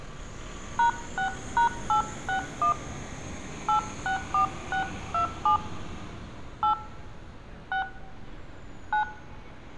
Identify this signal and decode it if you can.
DTMF, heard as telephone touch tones, dialled by hand, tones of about 110 ms, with street noise. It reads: #6#861 864627 8 6 9